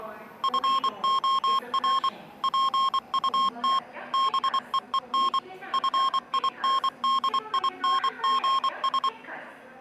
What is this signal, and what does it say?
Morse code, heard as electronic beeps, machine-sent, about 24 wpm, 1070 Hz, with the noise of a subway station. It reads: FOR PUT BEEN FINDINGS